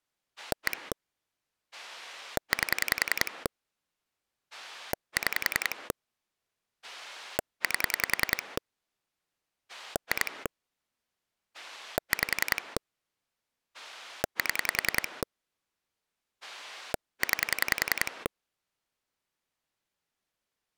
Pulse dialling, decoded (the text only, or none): 1 8 6 8 2 5 7 9